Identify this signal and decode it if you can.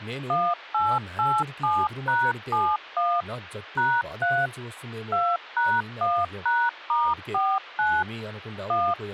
DTMF, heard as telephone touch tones, dialled by machine, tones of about 240 ms, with speech in Telugu. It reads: 1887#71 #3 2#1#*49 1